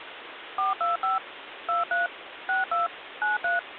DTMF, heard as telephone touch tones, dialled by machine, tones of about 150 ms, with phone line noise. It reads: 425 23 62 93